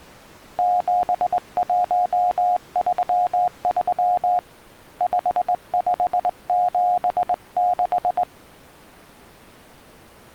Morse code, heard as a keyed tone, hand-sent with a straight key, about 20 wpm, 720 Hz. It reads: 7133 5576